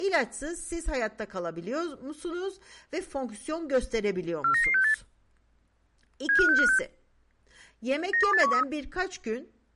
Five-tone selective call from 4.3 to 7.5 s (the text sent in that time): 49968 75656